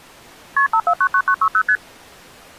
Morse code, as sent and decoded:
none

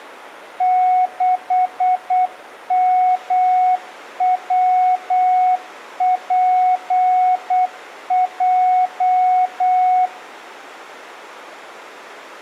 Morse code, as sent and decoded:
-.... -- .-- .--. .---
6MWPJ

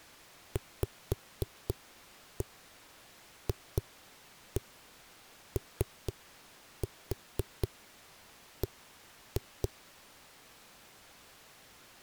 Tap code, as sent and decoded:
5-1 2-1 3-4 1-2
VFOB

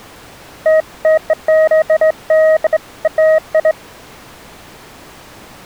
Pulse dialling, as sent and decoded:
none

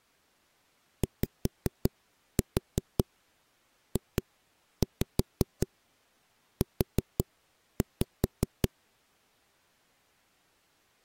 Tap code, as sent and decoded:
5-4 2-5 4-5
YJU

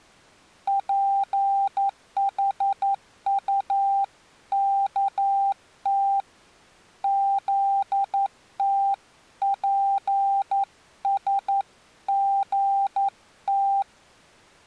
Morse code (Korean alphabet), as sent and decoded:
.--. .... ..- -.- - / --.. - .--. ... --. -
쥐어 터져서

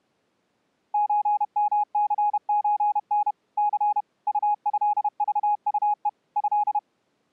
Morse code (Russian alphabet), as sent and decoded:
---. -- -.-. ---. -. / -.-. / ..- ..-.. ...- ..- . / ..-..
ЧМЦЧН Ц УЭЖУЕ Э

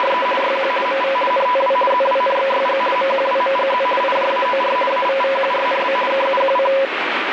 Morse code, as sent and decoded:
none

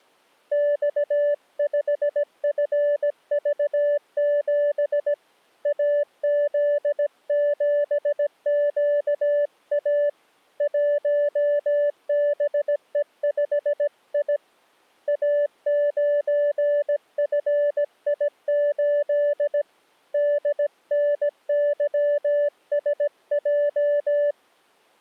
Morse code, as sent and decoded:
-..- ..... ..-. ...- --... / .- --.. --... --.- .- / .---- -... . ..... .. / .- ----. ..-. .. ---.. / -.. -. -.-- ... .---
X5FV7 AZ7QA 1BE5I A9FI8 DNYSJ

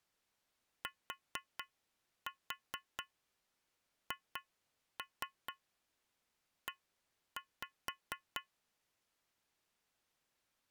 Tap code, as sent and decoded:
4-4 2-3 1-5
THE

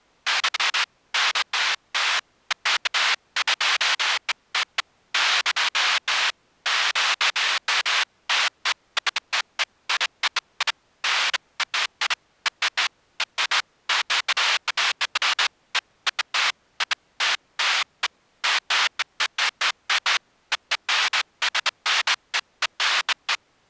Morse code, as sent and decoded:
none

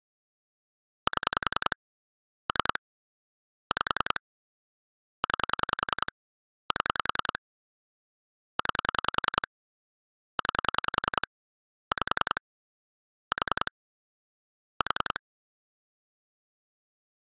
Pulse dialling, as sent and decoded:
7 / 3 / 5 / 9 / 7 / 9 / 9 / 5 / 4 / 4
7 3 5 9 7 9 9 5 4 4

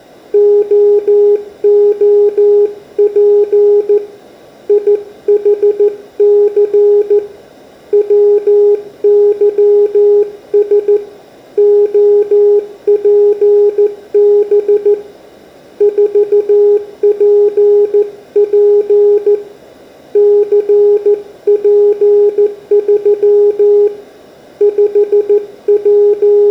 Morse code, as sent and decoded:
--- --- .--. / .. .... -.-. / .-- -.-- ... / --- .--. -... / ....- .--. .--. / -.-. .--. ...-- / …
OOP IHC WYS OPB 4PP CP3 …

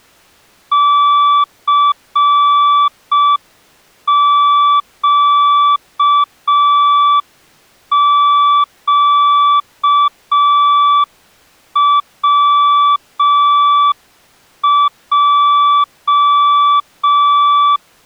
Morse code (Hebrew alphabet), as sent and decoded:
-.-. --.- --.- .-- .---
סקקצע

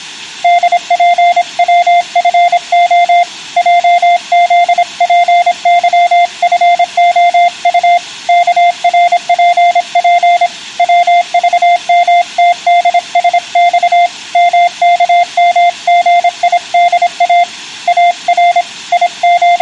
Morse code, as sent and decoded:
-.. .--. .-- ..-. --- / .--- --.. .--. -.-- ..-. --- ..- / -.- .-. .--. .--. / .-- ...- -- - -.. ... -..- / -- -.- -- --. .. -.. .- / .- .-. / …
DPWFO JZPYFOU KRPP WVMTDSX MKMGIDA AR …

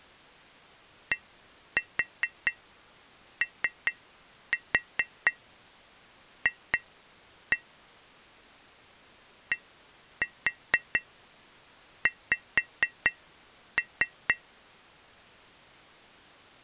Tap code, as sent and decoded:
1-4 3-4 2-1 / 1-4 5-3
DOF DX

